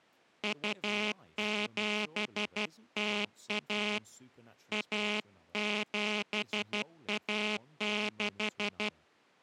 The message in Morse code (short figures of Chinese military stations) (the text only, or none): 2701 1716